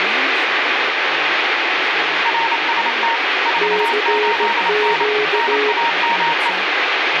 Morse code, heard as two keyed tones, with radio static and speech in Hebrew. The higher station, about 28 wpm, 930 Hz: RST 48N NAME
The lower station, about 16 wpm, 420 Hz: CQ